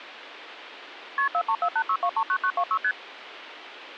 Multi-frequency trunk signalling (R1, as on North American trunks), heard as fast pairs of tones, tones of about 70 ms, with phone line noise. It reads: KP 43486239926 ST